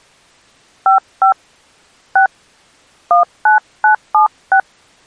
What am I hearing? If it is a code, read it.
DTMF, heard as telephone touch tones, dialled by hand, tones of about 100 ms. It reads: 55 6 19976